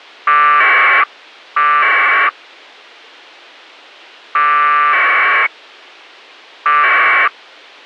Packet radio (AX.25, as in APRS), 1200 baud, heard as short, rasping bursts.